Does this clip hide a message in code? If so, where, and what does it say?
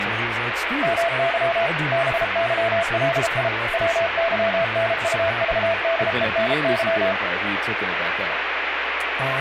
Yes: Morse code (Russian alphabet) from 0.8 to 7.2 s, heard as a keyed tone, machine-sent, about 33 wpm, 670 Hz, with radio static and speech in English. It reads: МЫ БЫЛИ ВЫНУЖДЕНЫ